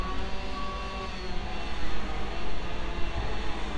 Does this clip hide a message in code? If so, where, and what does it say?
No, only street noise.